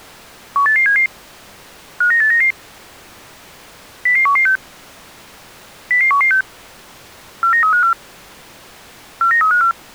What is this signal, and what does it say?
Five-tone selective call (CCIR), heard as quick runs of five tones, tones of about 100 ms. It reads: 18877 59899 00116 00116 49354 49354